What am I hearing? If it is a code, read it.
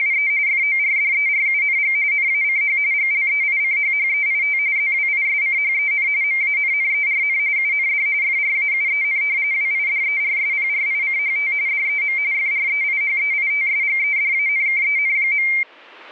RTTY (45.45 baud, 170 Hz shift), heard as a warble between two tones, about 2200 Hz centre. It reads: … FORDERUNG NACH GLEICHHEIT ZWISCHEN MANNERN UND FRAUEN WIDERSPRICHT DEM FREIHEITSGEDANKEN.